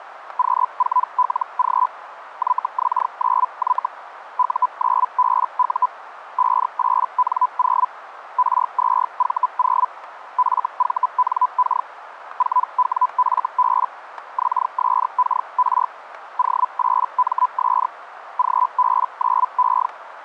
Hellschreiber (Feld-Hell, 122.5 baud), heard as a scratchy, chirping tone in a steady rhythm, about 1000 Hz, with radio static and static crashes. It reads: Q4LG YX9Y U9BU 58N0 R2V0 FVNK 4WFB XSKR O8MS GB9E